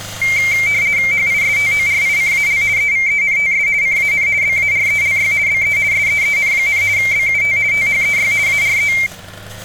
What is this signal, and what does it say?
RTTY (50 baud, 170 Hz shift), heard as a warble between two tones, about 2200 Hz centre, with street noise. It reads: HISTORICAL EVENTS CAN BARELY BE SEEN, BUT THEY ARE